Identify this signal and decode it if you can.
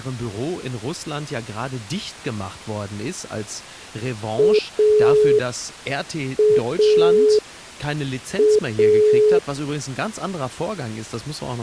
Telephone call progress tone (pulsed, as in Italy), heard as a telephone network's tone, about 420 Hz, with speech in German. Dial tone.